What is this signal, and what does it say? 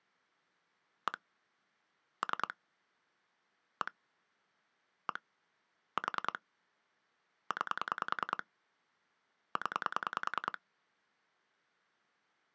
Pulse dialling, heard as clicks on a phone line, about 10 pulses a second. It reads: 1 3 1 1 4 9 0